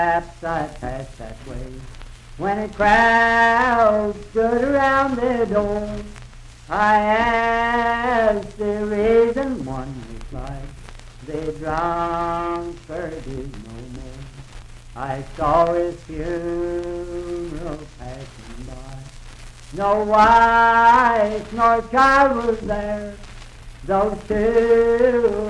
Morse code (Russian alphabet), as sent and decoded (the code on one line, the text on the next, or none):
none